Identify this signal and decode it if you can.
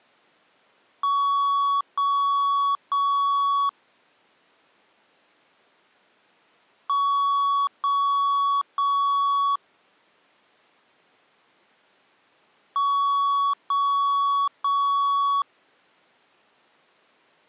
Beep code, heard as beeps, played three times, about 1120 Hz. 3 long. In IBM BIOS tables: keyboard card error.